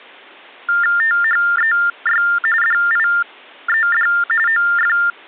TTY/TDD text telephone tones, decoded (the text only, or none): THEY DIED OF